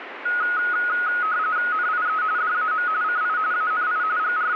RTTY (45.45 baud, 170 Hz shift), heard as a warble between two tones, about 1360 Hz centre, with radio static. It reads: NIE DAM CI ANI …